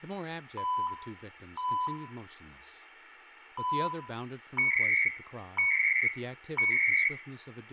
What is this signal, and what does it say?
Radio time signal (CHU, Canada), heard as beeps and data bursts, one a second, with room echo and speech in English.